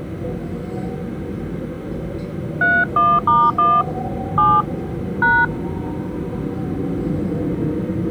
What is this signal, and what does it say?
DTMF, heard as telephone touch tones, dialled by hand, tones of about 230 ms, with the noise inside a subway train. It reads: 31*1 7 #